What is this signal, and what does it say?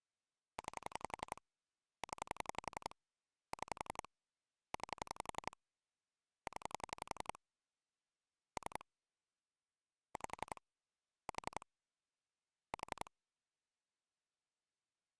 Pulse dialling, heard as clicks on a phone line, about 11 pulses a second. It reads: 9 0 6 9 0 3 5 4 4